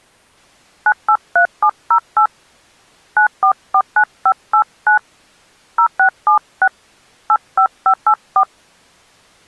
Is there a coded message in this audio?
Yes: DTMF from 0.9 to 8.4 s, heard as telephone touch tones, dialled by hand, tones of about 80 ms. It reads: 983708 9449589 0676 85584